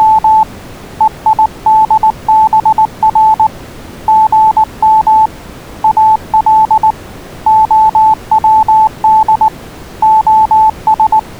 Morse code (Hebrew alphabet), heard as a keyed tone, hand-sent with a paddle, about 19 wpm, 870 Hz. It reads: … וידבר גם אל הצד …